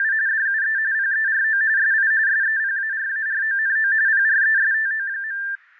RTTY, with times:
0.0-0.1 …
0.3-0.8 DUE
0.9-1.6 PERO
1.8-2.1 SI
2.3-3.9 SEPARARONO
4.1-5.4 PRESTO.

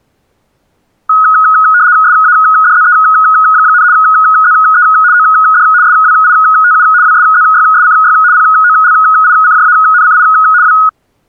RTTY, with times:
2.0-3.8 SADZE,
3.9-4.8 ZE
5.1-5.6 OD
5.8-6.8 SWITU
7.0-8.1 WSZYSCY
8.3-10.2 POLICJANCI
10.6-10.7 W

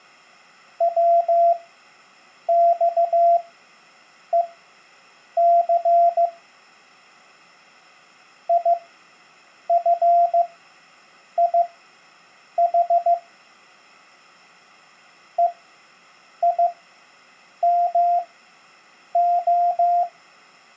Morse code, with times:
0.8-6.3 WXEC
8.5-13.1 IFIH
15.4-20.0 EIMO

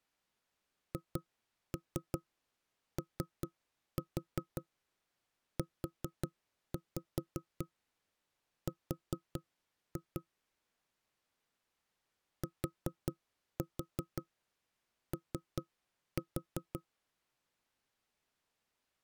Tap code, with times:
0.9-10.2 HOUR
12.4-16.8 TO

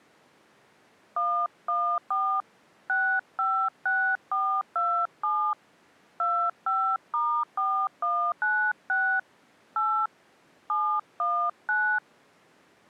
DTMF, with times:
1.2-2.4 114
2.9-5.5 656427
6.2-9.2 25*4196
9.8-10.1 8
10.7-12.0 719

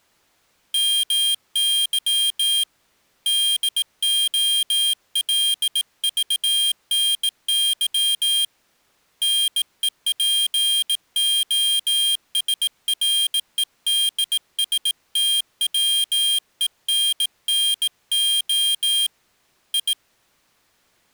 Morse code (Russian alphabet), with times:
0.7-2.6 МЫ
3.3-8.4 ДОЛЖНЫ
9.2-19.1 НЕПОСРЕДСТВЕННО
19.7-19.9 И

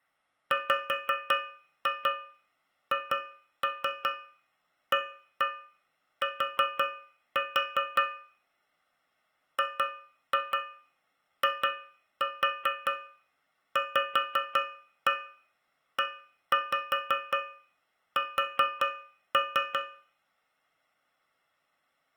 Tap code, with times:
0.5-8.0 WHAT
9.6-19.8 GIVES

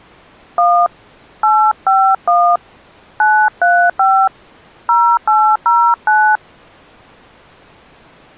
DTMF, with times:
0.6-0.9 1
1.4-2.6 851
3.2-4.3 935
4.9-6.4 0809

